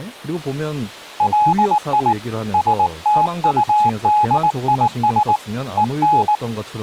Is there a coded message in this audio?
Yes: Morse code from 1.1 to 6.4 s, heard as a keyed tone, hand-sent with a paddle, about 19 wpm, 840 Hz, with speech in Korean. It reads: LI STUDIS EN